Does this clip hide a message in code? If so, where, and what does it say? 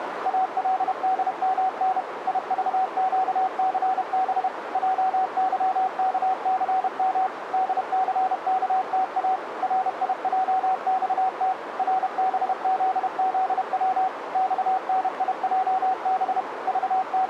Yes: Morse code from 0.2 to 17.3 s, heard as a keyed tone, machine-sent, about 31 wpm, 760 Hz, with radio static and a narrow filter. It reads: ALDMN IVQCB JYKCM DCKTA RIJXT RBZZW XNIJB …